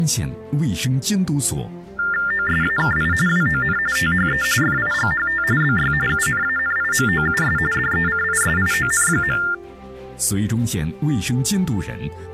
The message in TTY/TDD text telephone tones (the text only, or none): OSAKI WON THE FIGHT BY UNANIMOUS DECISION.